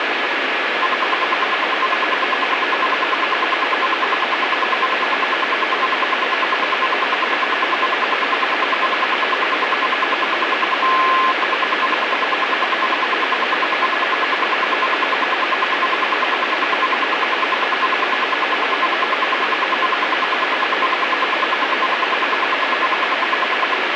Radio time signal (RWM, Moscow), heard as ten pulses a second, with radio static.